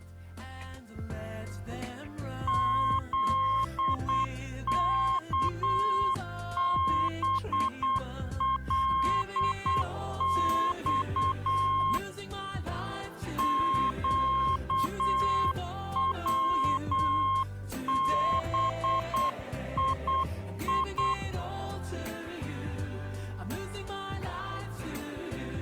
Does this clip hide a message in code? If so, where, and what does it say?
Yes: Morse code (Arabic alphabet) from 2.4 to 21.2 s, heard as a keyed tone, hand-sent with a paddle, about 8 wpm, 1070 Hz. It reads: ذكبلص قوبيي